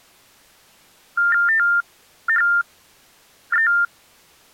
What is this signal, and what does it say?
TTY/TDD text telephone tones (45.45 baud Baudot), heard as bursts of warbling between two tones, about 400 Hz shift, 1600 Hz centre. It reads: THE